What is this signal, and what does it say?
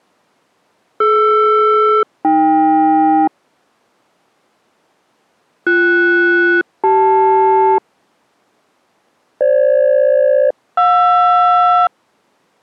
Aircraft SELCAL, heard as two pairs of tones. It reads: DR-AK BS-CL FG-JR